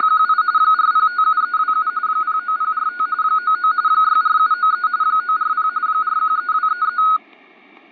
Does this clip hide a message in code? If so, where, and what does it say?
Yes: RTTY (45.45 baud, 170 Hz shift) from 0.0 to 7.2 s, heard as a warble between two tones, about 1360 Hz centre, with static crashes. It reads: … 4057327 09045 99 64793 940 413233